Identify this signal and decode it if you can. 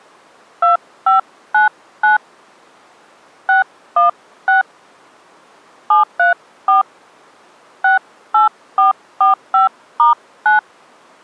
DTMF, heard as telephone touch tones, dialled by hand, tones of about 140 ms. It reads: 2599 616 734 68445*9